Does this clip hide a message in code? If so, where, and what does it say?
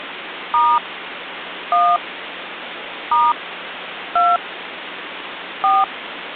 Yes: DTMF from 0.5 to 5.8 s, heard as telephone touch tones, dialled by hand, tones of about 210 ms, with phone line noise. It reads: * 1 * 2 4